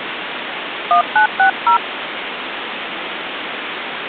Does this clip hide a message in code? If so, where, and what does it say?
Yes: DTMF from 0.9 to 1.8 s, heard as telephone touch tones, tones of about 100 ms, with phone line noise. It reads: 1960